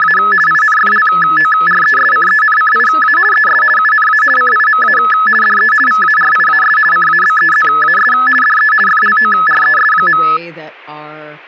RTTY (50 baud, 450 Hz shift), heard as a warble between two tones, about 1500 Hz centre, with static crashes and speech in English. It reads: … INFLORESCENCIA ES UNA CIMA DE VARIAS CABEZAS DE FLORES.